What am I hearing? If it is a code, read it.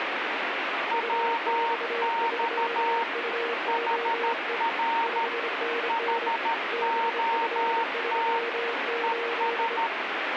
Morse code, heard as two keyed tones, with radio static. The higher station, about 13 wpm, 920 Hz: WX HR HOT ES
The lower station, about 25 wpm, 470 Hz: UX3UOE 5NN BF38